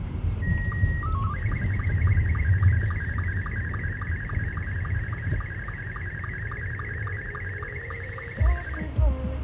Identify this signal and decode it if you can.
SSTV (slow-scan television), Scottie S2, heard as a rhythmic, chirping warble, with radio static, room echo and the noise inside a car.